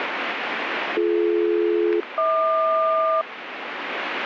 Aircraft SELCAL, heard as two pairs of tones, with radio static. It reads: BD-HQ